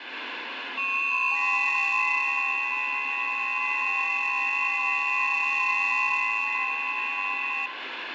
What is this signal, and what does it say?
FT8 (several signals at once), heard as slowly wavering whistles, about 6.25 baud, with radio static and room echo.